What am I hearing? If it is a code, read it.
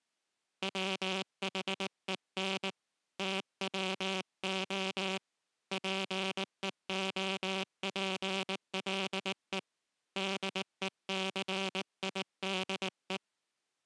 Morse code, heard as a buzzer, hand-sent with a paddle, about 19 wpm. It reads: WHEN TWO PEOPLE DECIDE